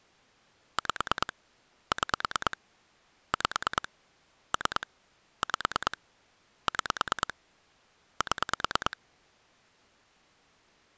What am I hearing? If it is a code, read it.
Pulse dialling, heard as clicks on a phone line, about 9 pulses a second. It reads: 5 6 5 3 5 6 7